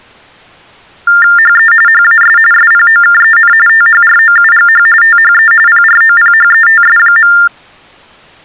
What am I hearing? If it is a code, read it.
TTY/TDD text telephone tones (45.45 baud Baudot), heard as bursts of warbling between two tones, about 400 Hz shift, 1600 Hz centre. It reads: HE HAS SPOKEN THROUGH THE PROPHETS.